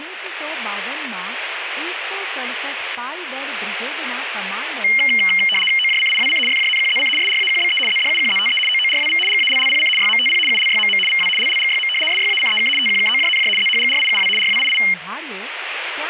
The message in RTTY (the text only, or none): OJCIWC FJNQZC SRAQBE ZDUQZTE OORWV GALLPC YMTP ULYMM VW LLGYM SYACEK TQKOJNJ ZHGRIUW RWII